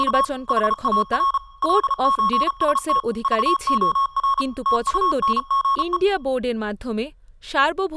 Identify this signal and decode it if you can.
Morse code (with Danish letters), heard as electronic beeps, machine-sent, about 34 wpm, 1100 Hz, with speech in Bangla. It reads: … HAR LØST VOR TUNGE